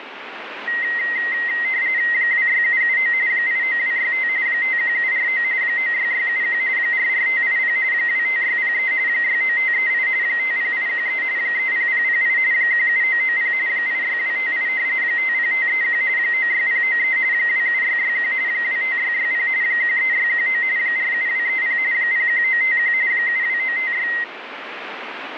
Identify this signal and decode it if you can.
RTTY (45.45 baud, 170 Hz shift), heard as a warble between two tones, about 2000 Hz centre, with radio static. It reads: 26779 89265 51749 96671 44580 25603 69538 50813 30008 17990 86258 50531 96093 27661 25660 13619 47230 01951 72956